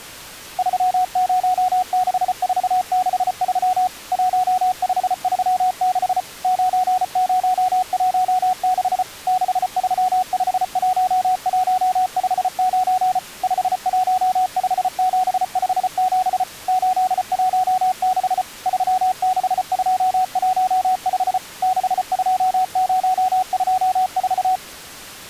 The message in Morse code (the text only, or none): 306463 1536 9016 6351159 515757 816 36215 62024